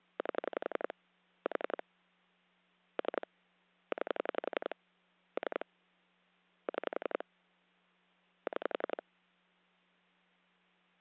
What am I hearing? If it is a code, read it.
Pulse dialling, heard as clicks on a phone line, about 11 pulses a second, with hum. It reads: 8 4 3 9 3 6 6